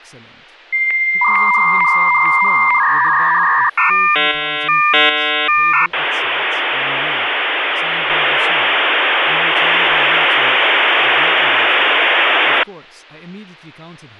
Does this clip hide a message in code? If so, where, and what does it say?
Yes: dial-up modem handshake (V.34 or later) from 0.7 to 12.6 s, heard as a whistle, warbles, then hiss, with hum and speech in English.